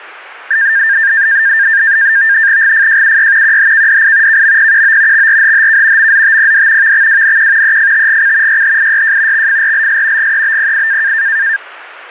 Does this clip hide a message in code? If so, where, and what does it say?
Yes: NAVTEX (SITOR-B), 100 baud, 170 Hz shift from 0.5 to 11.6 s, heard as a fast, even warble, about 1700 Hz centre, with radio static. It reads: GFJUY QHKDI KMPQO XRHHK MZTPD VXWNQ EFTGC YHIYJ XFRLS GEBPI